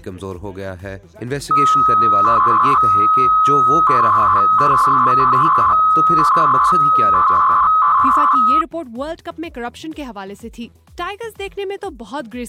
300-baud modem data (Bell 103 tones), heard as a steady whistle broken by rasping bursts, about 300 baud, 200 Hz shift.